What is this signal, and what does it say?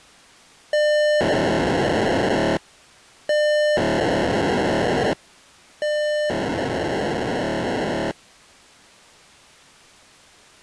POCSAG pager data (1200 baud), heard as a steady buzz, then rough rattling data.